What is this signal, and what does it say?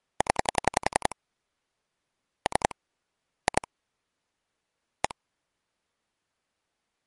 Pulse dialling, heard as clicks on a phone line, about 11 pulses a second. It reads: 0 3 2 1